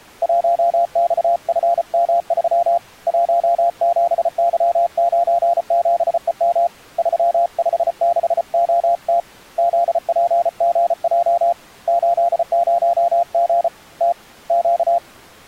Morse code, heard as a keyed tone, hand-sent with a paddle, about 34 wpm, 690 Hz. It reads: 1XFM3 17Y97EM 356OT ZPGJ 80G T Q